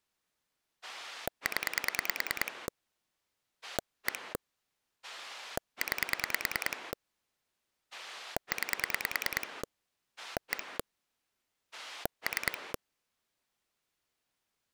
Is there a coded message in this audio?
Yes: pulse dialling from 0.8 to 12.8 s, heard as a rotary dial, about 9 pulses a second. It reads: 0 1 9 9 1 3